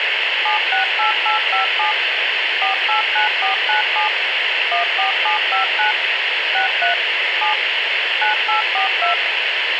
DTMF, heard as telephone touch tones, dialled by machine, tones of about 120 ms, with radio hiss. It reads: 768857 489497 14759 63 7 9842